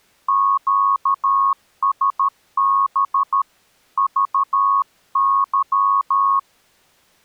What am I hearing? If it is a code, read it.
Morse code, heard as a keyed tone, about 13 wpm, 1100 Hz. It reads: QSB VY